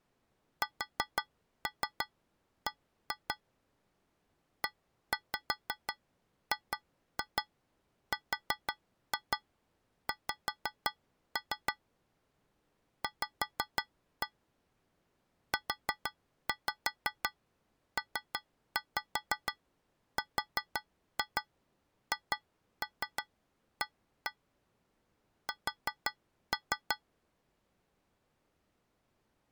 Tap code, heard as taps on a metal pipe, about 5 knocks a second. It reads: SB EGRX V UPRHA S